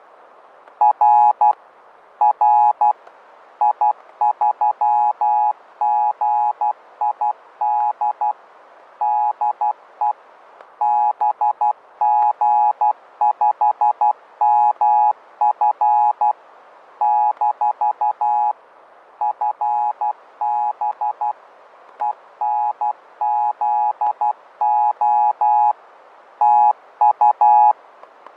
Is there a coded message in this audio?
Yes: Morse code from 0.8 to 27.8 s, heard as a keyed tone, machine-sent, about 12 wpm, 840 Hz, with fading and static crashes. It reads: R R I3GID DE BG5MF - FB ENZO TU